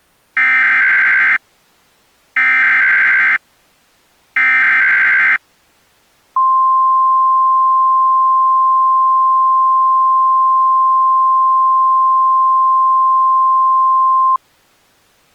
Emergency Alert System (SAME) tones (header bursts, then the 1050 Hz attention tone), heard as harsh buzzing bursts, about 520.83 baud.